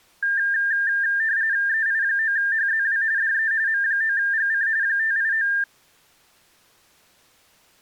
RTTY (45.45 baud, 170 Hz shift), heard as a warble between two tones, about 1700 Hz centre. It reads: EI9HZW DE M9GC 589